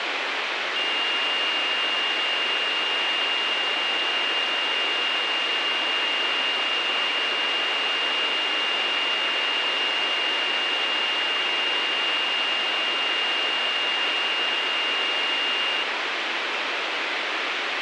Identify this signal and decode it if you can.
A steady tone, with radio hiss. There is no code.